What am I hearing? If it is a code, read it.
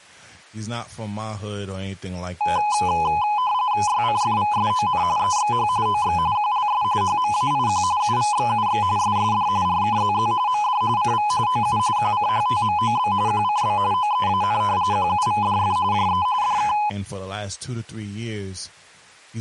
RTTY (45.45 baud, 170 Hz shift), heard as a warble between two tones, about 920 Hz centre, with speech in English. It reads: YCFVSON EXH OX QLS HMAIQ UVXUX SSD RKZZ MD CV OU QCHTMOB QCB OEAN QUVDF JE DK